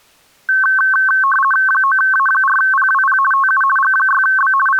RTTY (50 baud, 450 Hz shift), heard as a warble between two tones, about 1320 Hz centre. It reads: 9A4PWP TU G6B …